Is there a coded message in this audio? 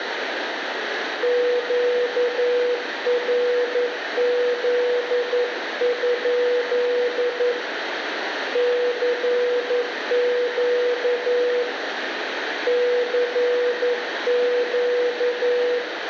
Yes: Morse code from 1.2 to 15.8 s, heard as a keyed tone, hand-sent with a paddle, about 11 wpm, 490 Hz, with radio static and room echo. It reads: QRZ? CQ CQ